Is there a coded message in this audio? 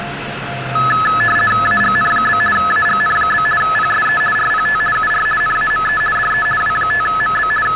Yes: RTTY (50 baud, 450 Hz shift) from 0.8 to 7.8 s, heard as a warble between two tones, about 1500 Hz centre, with radio static and the noise inside a subway train. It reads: AGN? AGN? PSE RPT UR NAME DE W5MB …